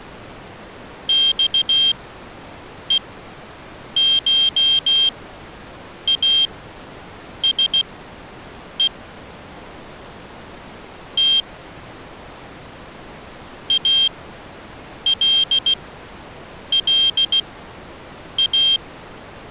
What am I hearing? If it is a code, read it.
Morse code (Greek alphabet), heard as a high beeper, machine-sent, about 16 wpm, spaced as for 7 wpm, 3200 Hz. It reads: ΞΕΧΑΣΕ Τ ΑΛΛΑ